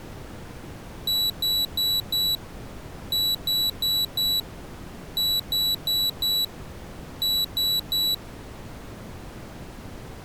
Beep code, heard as a piezo beeper, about 3950 Hz. 4-4-4-3.